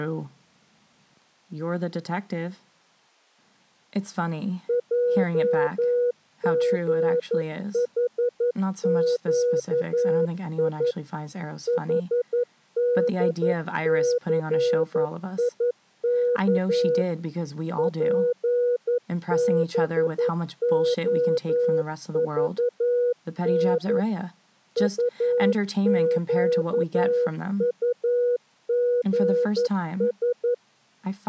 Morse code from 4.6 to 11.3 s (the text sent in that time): JGHQI